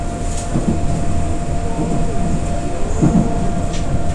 The noise inside a subway train. There is no code.